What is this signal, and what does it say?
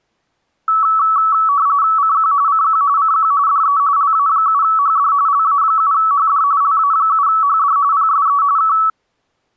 RTTY (45.45 baud, 170 Hz shift), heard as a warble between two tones, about 1220 Hz centre. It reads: CQ CQ CQ DE LA7HD LA7HD LA7HD PSE K